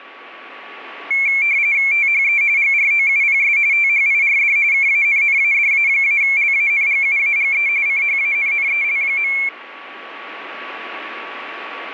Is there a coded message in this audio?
Yes: RTTY (45.45 baud, 170 Hz shift) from 1.1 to 9.5 s, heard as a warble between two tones, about 2250 Hz centre, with radio static and a steady whistle near 1130 Hz. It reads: THE GROUPS THIRD KANNADA-LANGUAGE CHANNEL.